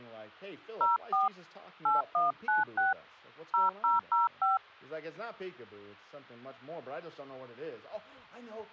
DTMF, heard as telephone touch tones, dialled by hand, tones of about 160 ms. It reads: 04 8196 0005